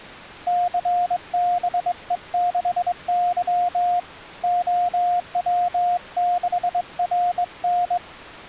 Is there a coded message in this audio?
Yes: Morse code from 0.4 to 8.0 s, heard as a keyed tone, hand-sent with a straight key, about 22 wpm, 710 Hz. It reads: CBE6Y OW6RN